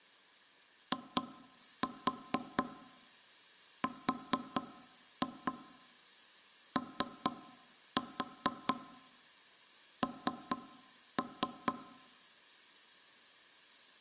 Tap code, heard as knocks on wood, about 4 knocks a second, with room echo. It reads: IRON